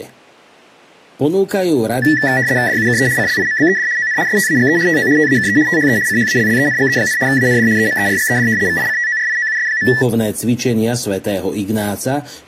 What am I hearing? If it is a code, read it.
RTTY (75 baud, 170 Hz shift), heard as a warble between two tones, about 1850 Hz centre, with speech in Slovak. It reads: DUKE CLIMBED ON STAGE TO TAKE THE CHALLENGE, AND EMERGED VICTORIOUS.